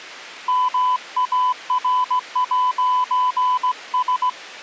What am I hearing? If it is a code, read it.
Morse code, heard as a keyed tone, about 17 wpm, 1000 Hz. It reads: MAR'S